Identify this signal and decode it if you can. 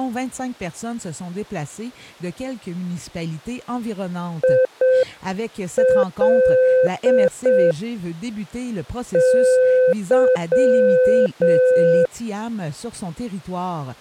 Morse code, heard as a keyed tone, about 6 wpm, 510 Hz. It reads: IL Y